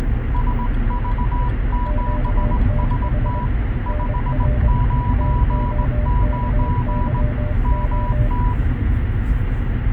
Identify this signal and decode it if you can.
Morse code, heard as two keyed tones, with radio static and the noise inside a car. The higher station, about 19 wpm, 980 Hz: SV7ST 599 MT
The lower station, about 23 wpm, 600 Hz: QTH NR TOKYO